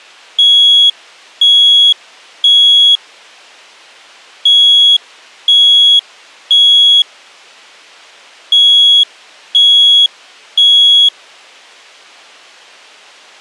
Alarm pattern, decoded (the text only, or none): temporal three